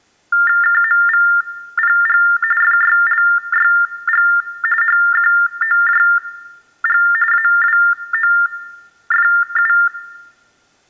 TTY/TDD text telephone tones (45.45 baud Baudot), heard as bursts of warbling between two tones, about 400 Hz shift, 1600 Hz centre, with room echo. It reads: KMVPG FYLYG HQOJG AWOFU